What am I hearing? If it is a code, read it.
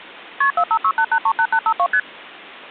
Multi-frequency trunk signalling (R1, as on North American trunks), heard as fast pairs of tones, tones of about 70 ms. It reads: KP 4568838852 ST